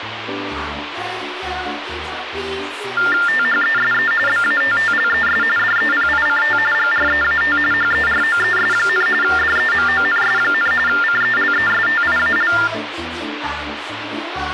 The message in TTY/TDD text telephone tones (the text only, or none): THESE BATTLES DEPICT GREAT HEROES, DEMONS, CELESTIAL